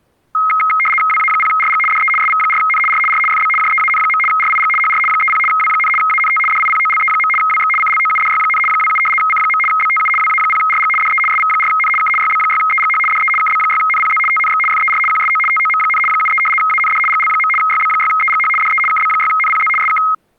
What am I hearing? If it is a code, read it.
RTTY (75 baud, 850 Hz shift), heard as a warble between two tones, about 1700 Hz centre. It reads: WA0RG DE SV4N R R FB JEAN. RIG HR 30 W, ANT DIPOLE. WX CLOUDY, 27 C. BTU WA0RG DE SV4N K YB6EGH DE KB6NPZ TNX FER QSO TOM, 73 AND GL. YB6EGH DE KB6NPZ SK